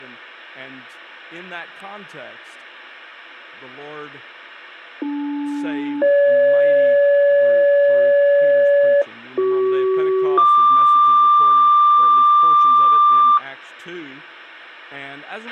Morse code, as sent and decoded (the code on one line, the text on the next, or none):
none